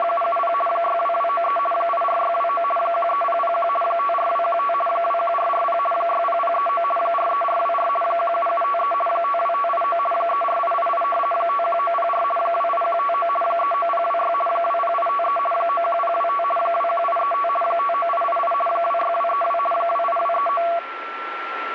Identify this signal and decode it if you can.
RTTY (50 baud, 450 Hz shift), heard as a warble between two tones, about 910 Hz centre, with radio static and a steady whistle near 1350 Hz. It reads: … 62293 84629 13001 54215 21440 60039 43424 17753 52589 34888 51904 28159 39026 20853 91025 21835 59888 26232 28239